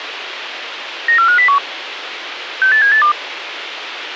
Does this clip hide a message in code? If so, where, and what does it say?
Yes: five-tone selective call (CCIR) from 1.1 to 3.1 s, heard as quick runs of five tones, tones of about 100 ms, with radio hiss. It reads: 94501 68782